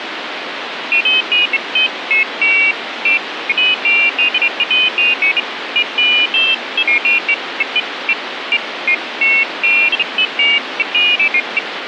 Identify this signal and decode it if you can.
Pairs of high tones at irregular times, with phone line noise. There is no code.